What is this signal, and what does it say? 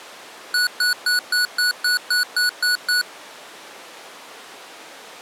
Beep code, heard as beeps from a small speaker, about 1470 Hz. 10 short. In AMI BIOS tables: CMOS shutdown register error.